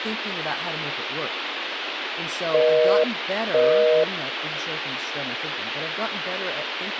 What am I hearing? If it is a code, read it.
Telephone call progress tone (North American plan), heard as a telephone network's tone, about 480, 620 Hz, 0.5 s on and 0.5 s off, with phone line noise and speech in English. Busy tone.